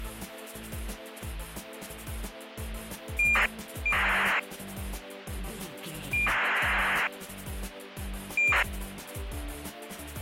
ACARS aircraft data, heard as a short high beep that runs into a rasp, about 2400 baud, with radio hiss.